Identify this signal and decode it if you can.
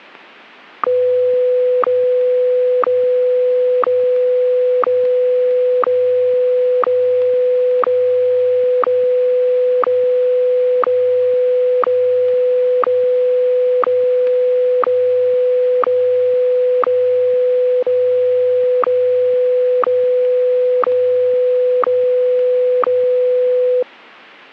Radio time signal (WWVH, Hawaii), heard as ticks, one a second.